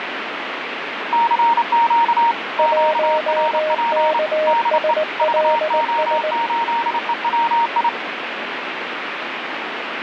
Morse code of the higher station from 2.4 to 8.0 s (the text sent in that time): QRP DE VO8EWI